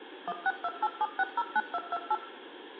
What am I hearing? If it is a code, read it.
DTMF, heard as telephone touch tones, dialled by machine, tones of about 40 ms, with room echo. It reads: 16287609228